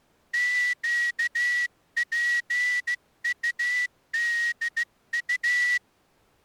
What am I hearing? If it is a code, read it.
Morse code, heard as a whistle, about 14 wpm. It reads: QPUDU